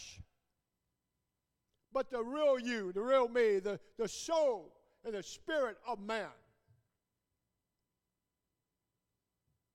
Speech in English. There is no code.